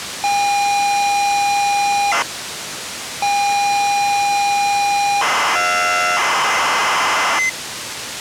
ZX Spectrum tape loading, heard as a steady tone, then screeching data, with tape hiss.